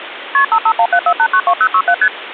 Multi-frequency trunk signalling (R1, as on North American trunks), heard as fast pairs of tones, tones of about 70 ms, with phone line noise. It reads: KP 55174892067 ST